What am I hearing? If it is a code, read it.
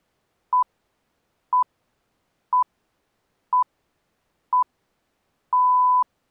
Radio time signal (six pips, as the Greenwich Time Signal), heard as pips.